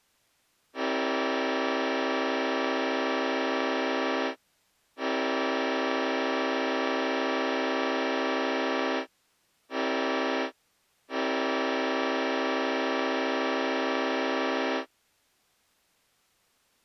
Train horn signal, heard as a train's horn. 2 long, 1 short, 1 long. On North American railways: approaching a public crossing.